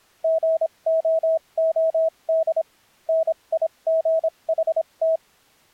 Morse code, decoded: GOOD NIGHT

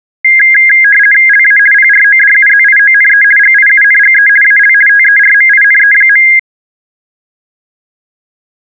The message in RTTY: LA PRODUZIONE GIUNGE AL TERMINE.

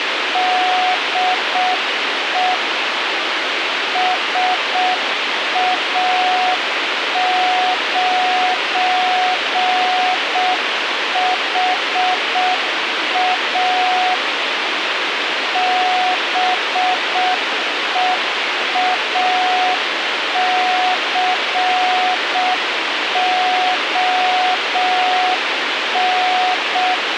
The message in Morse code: DE SA9HA BEACON

